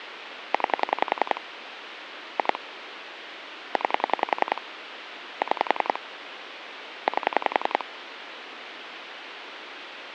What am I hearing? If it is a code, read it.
Pulse dialling, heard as clicks on a phone line, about 10 pulses a second, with phone line noise. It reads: 9 2 9 6 8